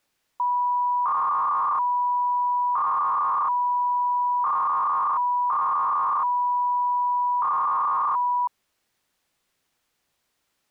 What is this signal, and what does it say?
300-baud modem data (V.21 tones), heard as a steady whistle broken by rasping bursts, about 300 baud, 200 Hz shift.